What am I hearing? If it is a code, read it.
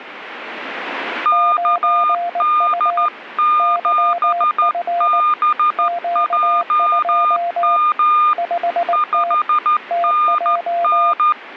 Morse code, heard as two keyed tones. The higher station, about 13 wpm, 1210 Hz: KD7BJM 5NN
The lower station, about 19 wpm, 690 Hz: 9U YF Q2 5T TJ